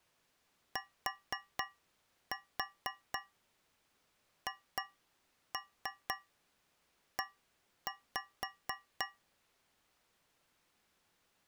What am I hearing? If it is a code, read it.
Tap code, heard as taps on a metal pipe, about 4 knocks a second. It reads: THE